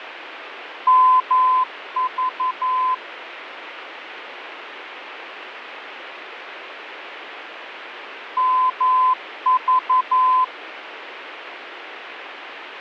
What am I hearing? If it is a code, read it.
Morse code, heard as a keyed tone, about 11 wpm, 1020 Hz, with radio static and fading. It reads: MV MV